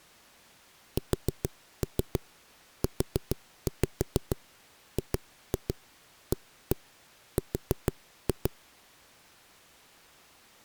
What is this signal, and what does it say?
Tap code, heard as knocks on a wall, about 6 knocks a second. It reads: SUGAR